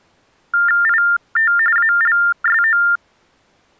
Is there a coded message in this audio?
Yes: TTY/TDD text telephone tones (45.45 baud Baudot) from 0.5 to 3.0 s, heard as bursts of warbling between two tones, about 400 Hz shift, 1600 Hz centre. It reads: IT ALSO